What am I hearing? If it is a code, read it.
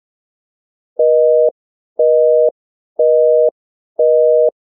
Telephone call progress tone (North American plan), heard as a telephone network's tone, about 480, 620 Hz, 0.5 s on and 0.5 s off. Busy tone.